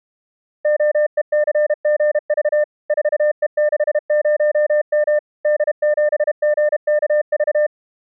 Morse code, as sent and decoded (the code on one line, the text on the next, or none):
--- . -.-. --. ...- / ....- . -.... ----- -- / -.. --... --. -.- ...-
OECGV 4E60M D7GKV